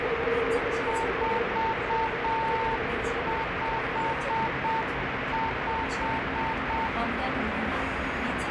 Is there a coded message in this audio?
Yes: Morse code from 0.8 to 6.9 s, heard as a keyed tone, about 7 wpm, 900 Hz, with heavy radio static and the noise inside a subway train. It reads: 455